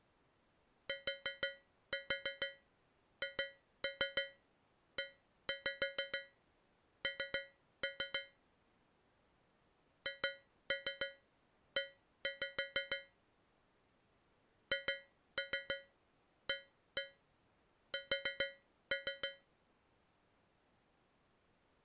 Tap code, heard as taps on a metal pipe, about 6 knocks a second. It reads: THEN HE HAS